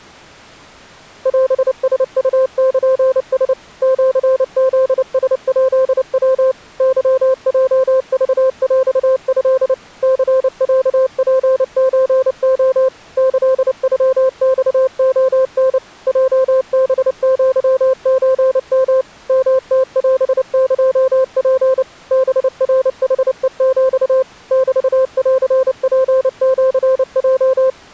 Morse code (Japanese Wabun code), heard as a keyed tone, machine-sent, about 29 wpm, 520 Hz. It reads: オラウルラ シフラヱヤ ケヲクヰト ニロツソレ キノマレタ ヲハアソヨ ヨムオエツ ハナヌヘヒ メンツシヲ